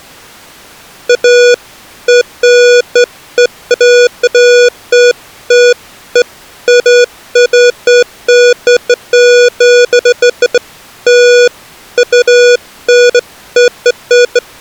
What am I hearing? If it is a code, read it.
Beeps of irregular length. There is no code.